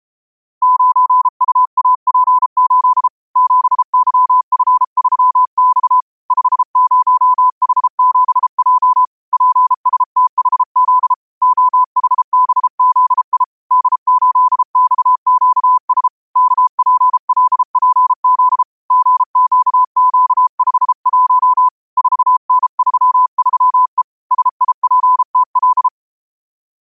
Morse code, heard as a keyed tone, hand-sent with a bug key, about 33 wpm, 1000 Hz. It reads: 9UAP8 7YF3X 50H7J PSTHZ OHBZI D8XQS KPLPZ GQQ51 4N33E SIPTL